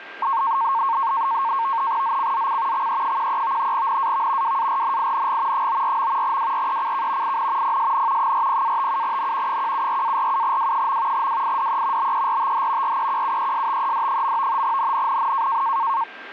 NAVTEX (SITOR-B), 100 baud, 170 Hz shift, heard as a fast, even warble, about 1000 Hz centre, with radio static and a steady whistle near 1590 Hz. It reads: ZCZC XE13 NAV WARNING 94. WRECK IN PSN 40-57N 174-47W. WIDE BERTH REQUESTED. NNNN